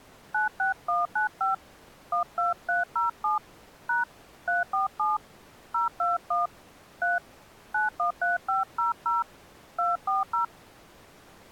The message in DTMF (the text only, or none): 96195 12307 # 347 021 3 913500 240